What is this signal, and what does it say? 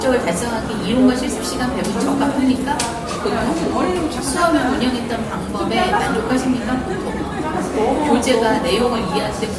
The noise of a cafe. There is no code.